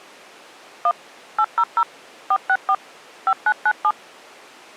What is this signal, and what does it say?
DTMF, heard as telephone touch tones, dialled by machine, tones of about 60 ms. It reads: 1 800 464 5997